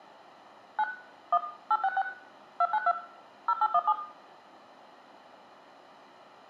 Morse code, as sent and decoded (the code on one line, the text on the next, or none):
none